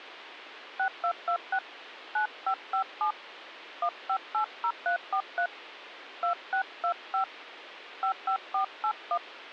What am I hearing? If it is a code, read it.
DTMF, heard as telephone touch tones, dialled by hand, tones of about 90 ms, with phone line noise. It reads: 6226 9557 1580343 2625 55481